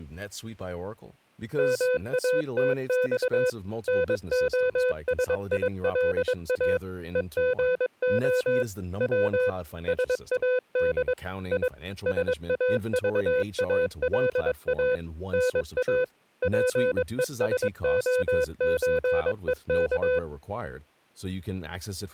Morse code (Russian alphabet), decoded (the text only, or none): МАТЬ НОСИЛА ЕГО В САД И САЖАЛА НА ПЕСОЧЕК